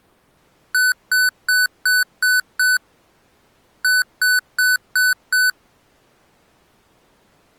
Beep code, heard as beeps from a small speaker, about 1500 Hz. 6-5.